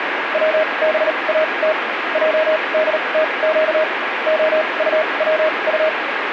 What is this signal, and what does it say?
Morse code, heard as a keyed tone, machine-sent, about 38 wpm, spaced as for 28 wpm, 630 Hz, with radio static. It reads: WBAT JDTQ OUWU